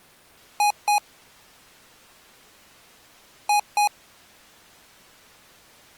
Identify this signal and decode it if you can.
Beep code, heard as beeps from a small speaker, played twice, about 830 Hz. 2 short. In AMI BIOS tables: memory parity error; in IBM BIOS tables: self-test error shown on screen; in Dell tables: no memory detected.